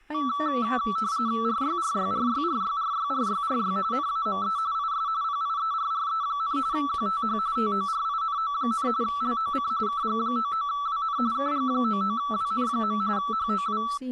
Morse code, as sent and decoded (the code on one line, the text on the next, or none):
none